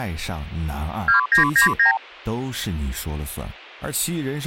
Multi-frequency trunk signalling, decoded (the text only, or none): 2999